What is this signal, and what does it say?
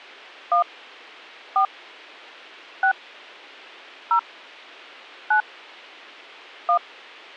DTMF, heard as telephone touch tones, dialled by hand, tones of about 90 ms. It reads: 1 4 6 0 9 1